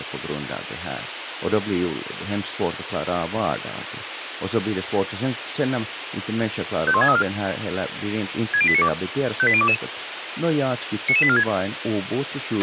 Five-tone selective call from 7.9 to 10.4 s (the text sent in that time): 60892 58022